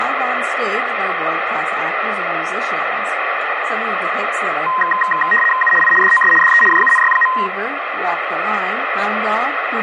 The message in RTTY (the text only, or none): U I DOS DE JUNY.